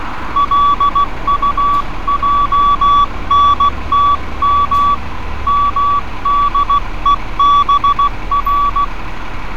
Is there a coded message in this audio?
Yes: Morse code (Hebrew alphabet) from 0.3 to 8.9 s, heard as a keyed tone, hand-sent with a paddle, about 16 wpm, 1140 Hz, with street noise. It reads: לטענתם מדובר